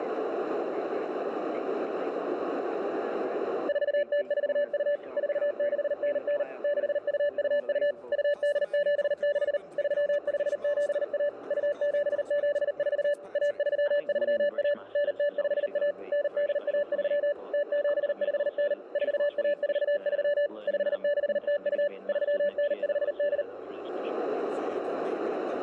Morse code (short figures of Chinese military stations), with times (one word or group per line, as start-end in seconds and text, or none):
3.7-5.0 4042
5.2-6.4 4699
6.6-7.9 6222
8.1-9.6 2876
9.8-11.3 3571
11.5-13.1 2774
13.4-14.7 1331
15.0-15.9 9051
16.1-17.3 9813
17.5-18.7 0759
19.0-20.5 4143
20.7-21.9 5602
22.1-23.4 3958